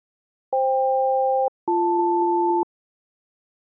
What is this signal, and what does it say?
Aircraft SELCAL, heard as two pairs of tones. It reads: FK-BL